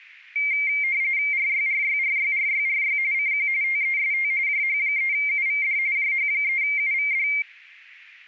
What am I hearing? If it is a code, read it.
RTTY (45.45 baud, 170 Hz shift), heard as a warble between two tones, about 2200 Hz centre. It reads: RYRYRYRYRY CQ TEST JH3UVD JH3UVD